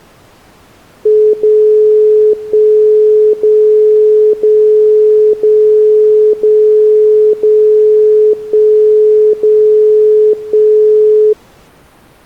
Radio time signal (DCF77), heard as a tone whose level steps once a second, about 430 Hz. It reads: 0 1 0 0 0 0 0 1 0 1